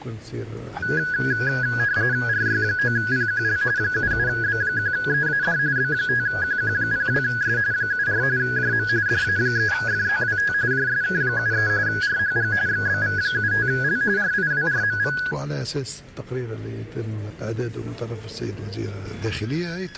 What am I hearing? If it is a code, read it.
RTTY (45.45 baud, 170 Hz shift), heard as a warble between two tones, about 1550 Hz centre. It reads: RY9PQL 77B1EAD B5QQ02S 74 JM DA3FZWT JSK73 RHG XBV75L RIWRMV